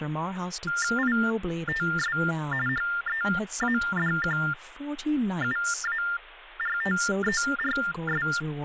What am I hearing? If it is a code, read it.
TTY/TDD text telephone tones (45.45 baud Baudot), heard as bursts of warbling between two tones, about 400 Hz shift, 1600 Hz centre, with phone line noise and speech in English. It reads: ITS HEADQUARTERS